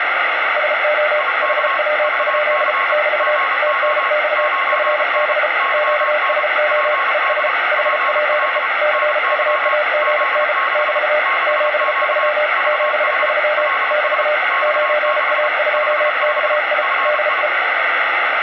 Morse code, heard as two keyed tones, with heavy radio static. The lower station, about 34 wpm, 600 Hz: SO HW? <BT> TNX FB QSO ES HPE CUAGN <BT> 73 73 <BT> 9A2XI DE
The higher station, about 31 wpm, 1090 Hz: IK VC GO 9N YN PD PL NY Z6 6Q VH LS X6 55 FI